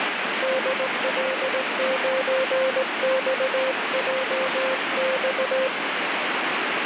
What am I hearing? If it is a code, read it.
Morse code, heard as a keyed tone, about 18 wpm, 520 Hz, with heavy radio static. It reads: DL9XJX